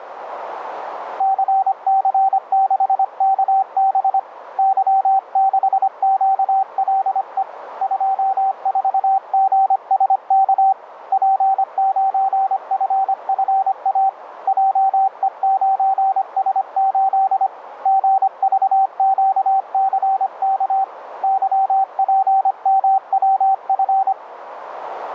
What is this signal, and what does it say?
Morse code, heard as a keyed tone, hand-sent with a paddle, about 25 wpm, 770 Hz, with radio static and a narrow filter. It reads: CC6KB Y6QLE 24GSK P9FFA JE9S8 GVQCK YPMWF